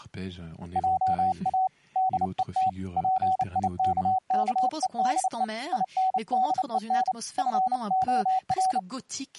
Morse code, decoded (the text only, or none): JA DET PIKKEDE INDEN FOR